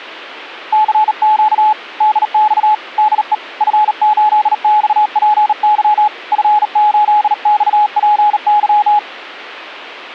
Morse code, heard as a keyed tone, hand-sent with a bug key, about 38 wpm, 850 Hz. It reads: CQ DX DE F8XPY F8XPY